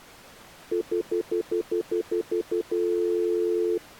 Telephone call progress tone (North American plan), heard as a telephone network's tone, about 350, 440 Hz, 0.1 s on and 0.1 s off. Stutter dial tone.